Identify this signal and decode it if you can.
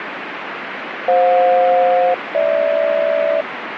Aircraft SELCAL, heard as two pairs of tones, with radio static. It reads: FJ-GH